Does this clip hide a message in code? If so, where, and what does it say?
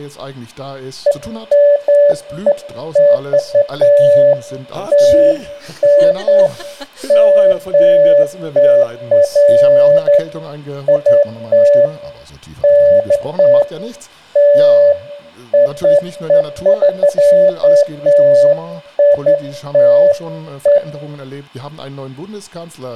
No, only beeps of irregular length, with room echo.